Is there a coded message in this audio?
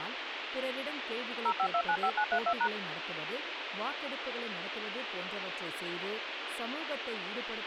Yes: DTMF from 1.5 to 2.7 s, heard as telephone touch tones, dialled by machine, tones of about 70 ms, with phone line noise and speech in Tamil. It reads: 05295932#